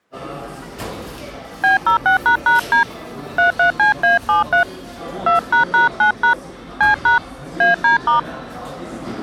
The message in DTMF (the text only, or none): B06##D 33CA73 2##9# C# AD*